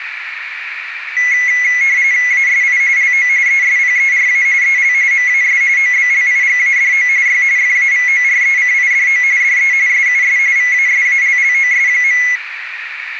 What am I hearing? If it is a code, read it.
RTTY (45.45 baud, 170 Hz shift), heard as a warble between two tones, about 2050 Hz centre, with radio static and a narrow filter. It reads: ASI LO ESPERA EL MAS OBLIGADO Y FAVORECIDO DE SUS VASALLOS.